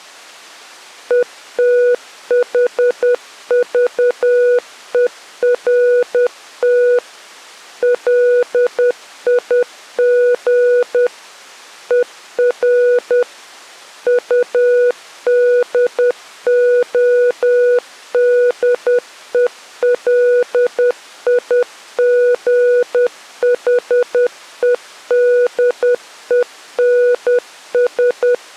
Morse code, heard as a keyed tone, machine-sent, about 10 wpm, 490 Hz. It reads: ETHVERT LIG ER UDODELIGHEDENS